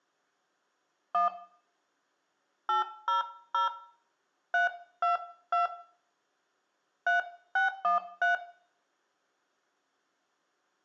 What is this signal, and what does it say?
DTMF, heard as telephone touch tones, dialled by hand, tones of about 140 ms, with room echo. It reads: 1 800 322 3613